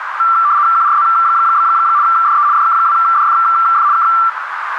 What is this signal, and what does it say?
RTTY (75 baud, 170 Hz shift), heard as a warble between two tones, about 1260 Hz centre, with radio static and a narrow filter. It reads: QRZ? DE DK2DFF K